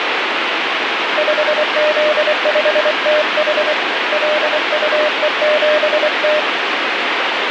Morse code, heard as a keyed tone, hand-sent with a paddle, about 24 wpm, 610 Hz, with heavy radio static. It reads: 5Z5TH LUE7T